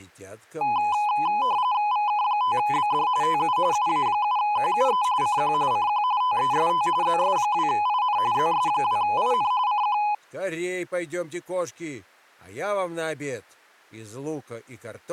RTTY (45.45 baud, 170 Hz shift), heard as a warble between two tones, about 920 Hz centre. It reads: VK5BD TU UA7QUE CQ CQ TEST ZS2IN ZS2IN CQ